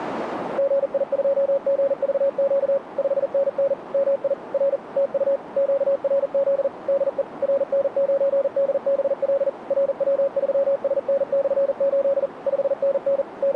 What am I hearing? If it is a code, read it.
Morse code, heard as a keyed tone, machine-sent, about 40 wpm, 550 Hz, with radio static and a narrow filter. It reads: GI2GVQ 5NN MI R TU QRZ DE RN9DBL RW3SN/8 5NN …